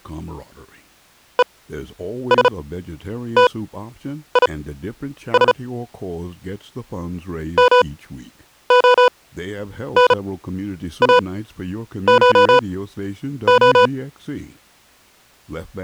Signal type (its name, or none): Morse code